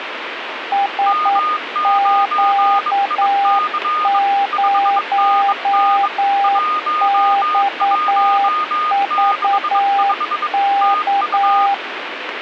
Morse code, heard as two keyed tones, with radio static. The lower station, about 9 wpm, 800 Hz: SQ0XVK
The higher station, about 22 wpm, 1230 Hz: M9IC 5NN 1165 TU